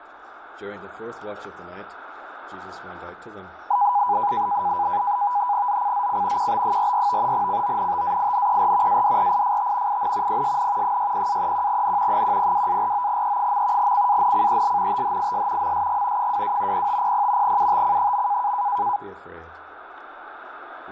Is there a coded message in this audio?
Yes: NAVTEX (SITOR-B), 100 baud, 170 Hz shift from 3.7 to 19.0 s, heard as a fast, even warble, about 900 Hz centre, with radio static and static crashes. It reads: ZCZC QB44 CONTAINER ADRIFT IN PSN 60-31N 102-49E. CANCEL THIS MSG 22 0500 UTC.